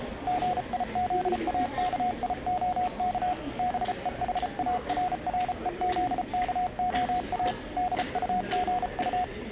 Morse code, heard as a keyed tone, hand-sent with a paddle, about 34 wpm, 730 Hz, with the noise of a crowd indoors. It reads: GIZAKIOK BEHARREZKOA DUGU